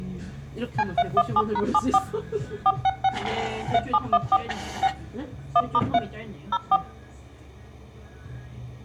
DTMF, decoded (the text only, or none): C317#74 466 3714 6 1*3 04